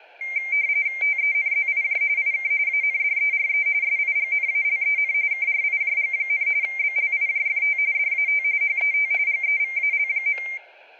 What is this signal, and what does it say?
RTTY (45.45 baud, 170 Hz shift), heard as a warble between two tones, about 2200 Hz centre, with static crashes. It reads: TENZIJ IK ANDERE SIGNALEN KRIJG, BLIJFT DAT HET GEVAL.